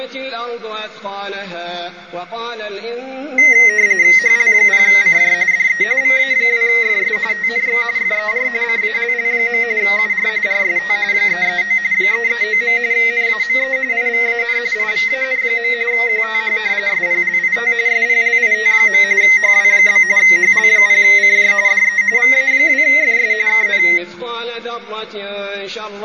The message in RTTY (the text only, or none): HL0CJ DE VA2FS TNX FER CALL. UR RST 339 339. NAME IVAN IVAN. QTH SPLIT SPLIT. HW? HL0CJ DE VA2FS KN